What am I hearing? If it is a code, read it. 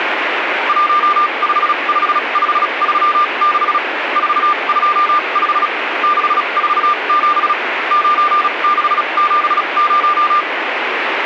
Morse code, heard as a keyed tone, machine-sent, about 36 wpm, spaced as for 29 wpm, 1200 Hz, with radio static. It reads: 155536 425 647 9670